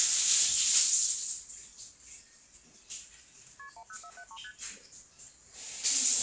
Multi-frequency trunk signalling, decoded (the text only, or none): KP 10473 ST